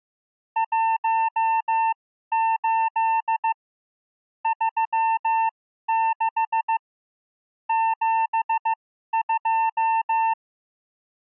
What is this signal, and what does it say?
Morse code, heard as a keyed tone, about 15 wpm, spaced as for 12 wpm, 900 Hz. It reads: 18 36 72